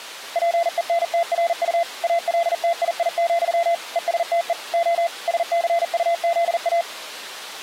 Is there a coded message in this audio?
Yes: Morse code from 0.3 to 6.9 s, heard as a keyed tone, machine-sent, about 40 wpm, 680 Hz. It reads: PENTRU ALTII, ESTE O SCUZA